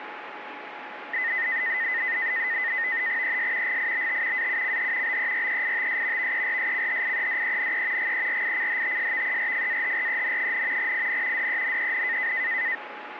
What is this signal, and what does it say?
NAVTEX (SITOR-B), 100 baud, 170 Hz shift, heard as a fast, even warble, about 1950 Hz centre, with radio static and a steady whistle near 840 Hz. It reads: ES GIBT AUCH BEREITS VERSCHIEDENE GERICHTSVERFAHREN, IN DENEN